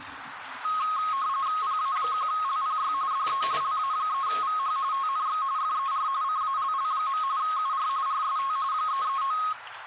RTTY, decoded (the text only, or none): PA1LPY DE LA3VH TNX FER CALL. UR RST 339